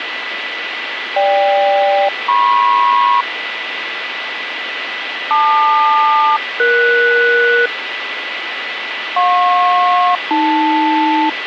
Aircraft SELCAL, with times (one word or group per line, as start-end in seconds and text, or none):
1.2-3.2 GK-MP
5.3-7.7 LQ-ES
9.2-11.3 JP-AL